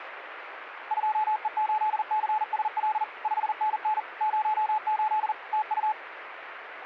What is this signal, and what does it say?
Morse code, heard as a keyed tone, machine-sent, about 40 wpm, 860 Hz, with radio static. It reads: 2E8CSL 5NN 08 TU